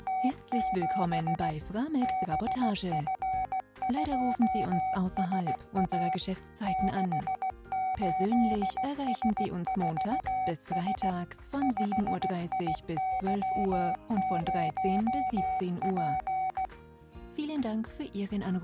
Morse code, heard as a keyed tone, machine-sent, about 16 wpm, 750 Hz. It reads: … BF2SA 68S4S 5IY0P